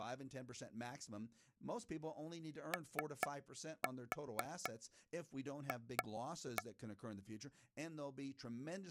Tap code, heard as taps on a table, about 4 knocks a second, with speech in English. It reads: OF